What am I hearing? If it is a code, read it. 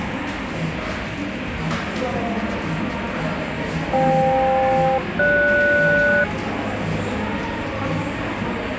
Aircraft SELCAL, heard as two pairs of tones, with radio static and the noise of a cafe. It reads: FK-GS